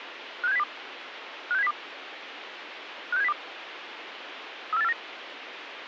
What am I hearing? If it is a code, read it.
Five-tone selective call (EEA), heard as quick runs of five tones, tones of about 40 ms, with radio hiss. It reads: 56702 56702 56702 34849